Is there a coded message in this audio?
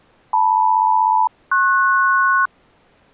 Yes: aircraft SELCAL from 0.3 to 2.5 s, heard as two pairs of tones. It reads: LM-PS